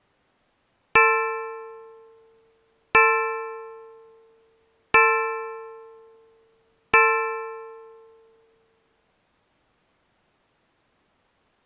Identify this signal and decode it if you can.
Clock strike, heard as a bell. 4. Four o'clock.